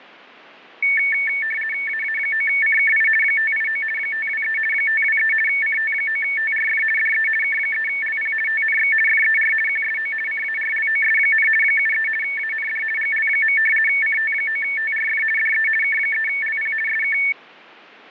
RTTY (50 baud, 450 Hz shift), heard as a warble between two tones, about 2000 Hz centre. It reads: AA9CKI 589 523 523 CT9TRF DE K3LP TNX FER QSO CARLOS, 73 AND GL. CT9TRF DE K3LP SK